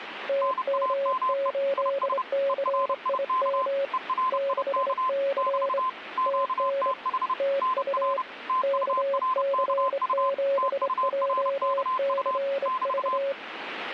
Morse code, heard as two keyed tones, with radio static. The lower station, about 25 wpm, 550 Hz: TM8CIM 6C TN TU KC7JCV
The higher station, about 30 wpm, 1030 Hz: NAME IS ERIK ERIK <BT> QTH NR TURKU TURKU <BT>